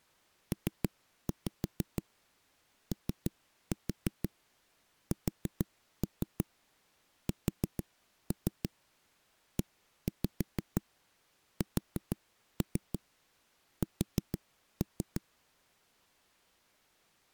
Tap code, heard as knocks on a wall, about 6 knocks a second. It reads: POSSESS